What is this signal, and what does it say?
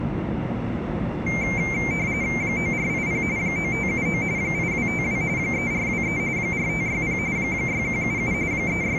RTTY (45.45 baud, 170 Hz shift), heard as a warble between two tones, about 2200 Hz centre, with the noise inside a subway train. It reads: 9480 9579 8252 3423 4560 6177 …